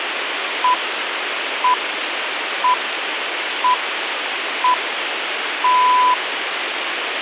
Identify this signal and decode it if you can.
Radio time signal (six pips, as the Greenwich Time Signal), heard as pips, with radio hiss.